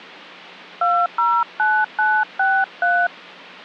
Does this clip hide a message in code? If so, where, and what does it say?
Yes: DTMF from 0.8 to 3.1 s, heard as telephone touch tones, dialled by hand, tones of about 250 ms. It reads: 209963